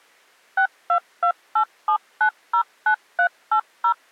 DTMF, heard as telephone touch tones, dialled by machine, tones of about 80 ms. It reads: 62287909380